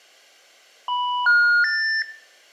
Telephone call progress tone (North American plan), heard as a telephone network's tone, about 980, 1430, 1800 Hz, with room echo. Special information tone.